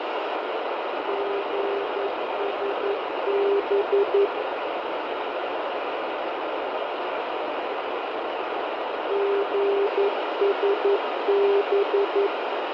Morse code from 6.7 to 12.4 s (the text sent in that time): GSB